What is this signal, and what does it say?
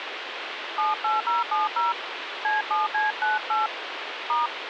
DTMF, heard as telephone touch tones, dialled by hand, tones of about 160 ms, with phone line noise. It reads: 78070 C7C98 *